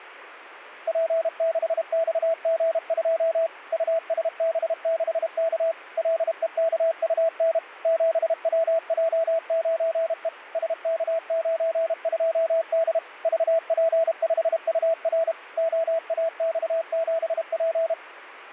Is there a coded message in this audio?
Yes: Morse code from 0.8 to 18.0 s, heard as a keyed tone, machine-sent, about 32 wpm, 660 Hz. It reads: P6XG2 USB6K LEKUN 7WJ9E SK92D VP5UR OAX7P